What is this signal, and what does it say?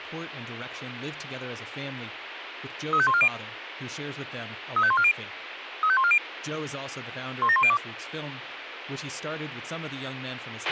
Five-tone selective call (ZVEI), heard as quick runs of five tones, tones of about 70 ms, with radio hiss, a squelch burst at the end and speech in English. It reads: 35140 35140 35140 17102